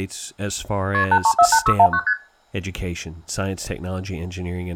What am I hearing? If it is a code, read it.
Multi-frequency trunk signalling (R1, as on North American trunks), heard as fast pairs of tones, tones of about 70 ms, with speech in English. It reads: KP 8348619 ST